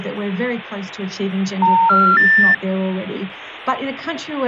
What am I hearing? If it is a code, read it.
Telephone call progress tone (North American plan), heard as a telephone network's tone, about 910, 1370, 1800 Hz. Special information tone.